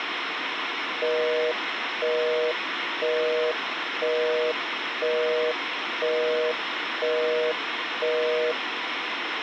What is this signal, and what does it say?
Telephone call progress tone (North American plan), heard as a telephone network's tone, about 480, 620 Hz, 0.5 s on and 0.5 s off, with phone line noise. Busy tone.